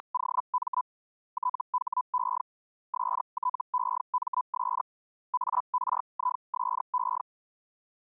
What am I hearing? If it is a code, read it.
Hellschreiber (Feld-Hell, 122.5 baud), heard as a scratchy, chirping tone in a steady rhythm, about 1000 Hz. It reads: … THE STEMS ARISE